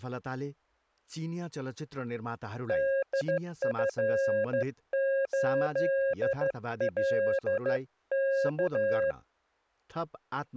Morse code, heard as a keyed tone, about 13 wpm, 540 Hz, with speech in Nepali. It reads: DF8LK